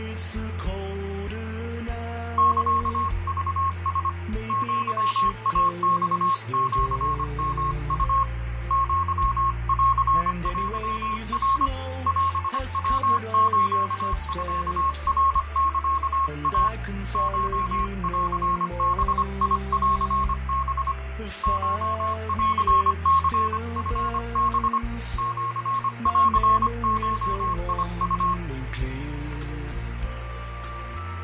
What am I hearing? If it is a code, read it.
Morse code (Japanese Wabun code), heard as a keyed tone, hand-sent with a paddle, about 25 wpm, 1080 Hz, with radio static and fading. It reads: サクラ アイマシヨウ アンテナ オヤスミナサイ コンバンハ コンニチハ シンゴウ